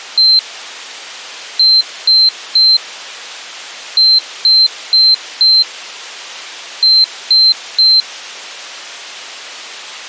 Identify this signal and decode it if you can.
Beep code, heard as a piezo beeper, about 4100 Hz. 1-3-4-3. In Phoenix BIOS tables: memory failure on data bits.